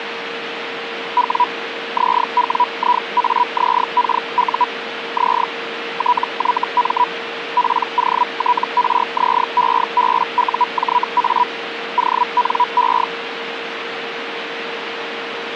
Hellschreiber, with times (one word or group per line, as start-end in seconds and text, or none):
1.2-1.4 W
2.0-4.6 ZWIAZKU
5.2-5.4 Z
6.0-7.0 TYM
7.6-11.4 POTRZEBUJA
12.0-13.0 ONE